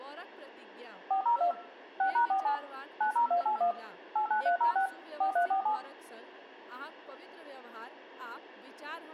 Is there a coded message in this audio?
Yes: DTMF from 1.1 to 5.8 s, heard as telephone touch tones, dialled by machine, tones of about 100 ms, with room echo and speech in Maithili. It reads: 402 6#47 90281 89306 4347